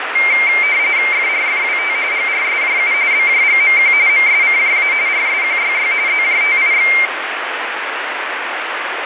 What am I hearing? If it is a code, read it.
RTTY (45.45 baud, 170 Hz shift), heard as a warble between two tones, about 2200 Hz centre, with radio static. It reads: FRFWT GRSJU BJGMQ MSCJA RSQYY ZJTIX